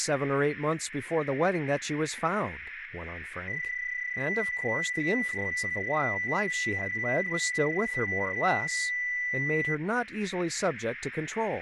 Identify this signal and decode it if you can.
PSK31 (31.25 baud), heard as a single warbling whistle, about 2000 Hz, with radio static and speech in English.